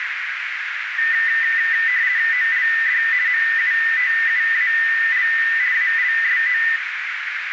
RTTY (50 baud, 170 Hz shift), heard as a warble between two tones, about 1900 Hz centre, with radio static and a narrow filter. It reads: OLD MUTUAL ALSO